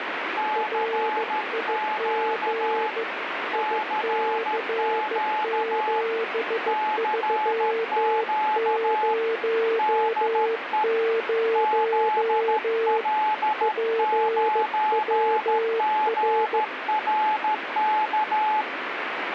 Morse code, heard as two keyed tones, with heavy radio static. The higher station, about 13 wpm, 860 Hz: CQ CQ CQ DE ZL9GRK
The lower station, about 15 wpm, 450 Hz: RIG IC7300 PWR